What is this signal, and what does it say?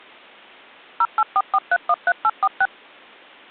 DTMF, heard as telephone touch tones, dialled by machine, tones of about 50 ms. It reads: 0844313846